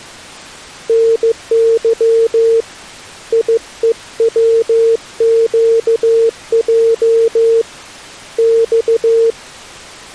Morse code, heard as a keyed tone, hand-sent with a paddle, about 15 wpm, 460 Hz. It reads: NY IEWQJ X